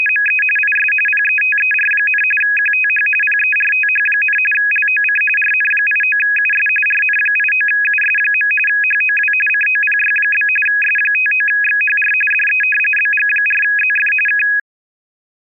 RTTY (45.45 baud, 850 Hz shift), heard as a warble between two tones, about 2100 Hz centre. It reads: … IS PETER, QTH PERTH, LOC RN89US RN89US. HOW COPY? S59XHR DE BG4ZF K